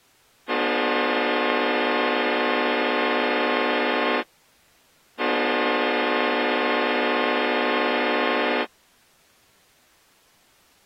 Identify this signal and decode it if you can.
Train horn signal, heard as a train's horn. 2 long. On North American railways: brakes released, proceed.